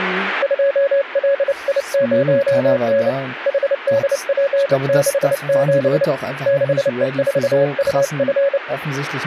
Morse code, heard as a keyed tone, hand-sent with a bug key, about 29 wpm, 560 Hz, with speech in German. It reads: 2LI0N HDP67 6E4UF